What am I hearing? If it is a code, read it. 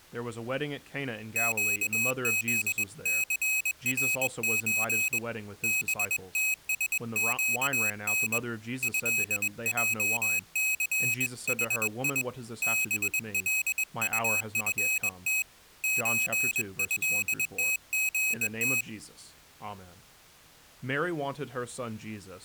Morse code (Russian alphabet), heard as a high beeper, hand-sent with a bug key, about 21 wpm, 2550 Hz, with speech in English. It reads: ЩЗЦРЧ БТСЩН ЭЙЦХИ БЛУФТ ЧЭТГТ